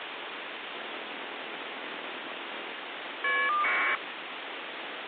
Caller ID data burst, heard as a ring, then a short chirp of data, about 1200 baud, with phone line noise.